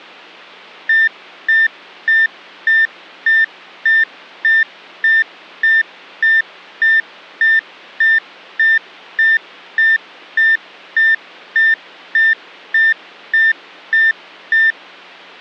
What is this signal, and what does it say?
Evenly repeated beeps. There is no code.